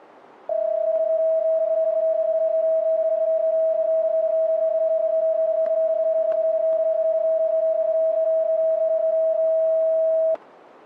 PSK31 (31.25 baud), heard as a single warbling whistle, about 640 Hz, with static crashes.